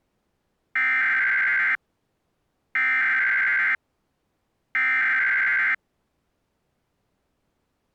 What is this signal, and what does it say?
Emergency Alert System (SAME) tones (header bursts), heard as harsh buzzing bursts, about 520.83 baud.